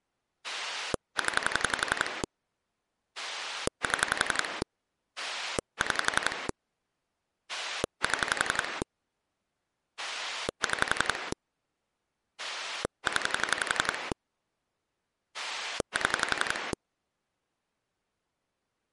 Pulse dialling, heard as a rotary dial, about 11 pulses a second. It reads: 0 7 6 7 6 0 7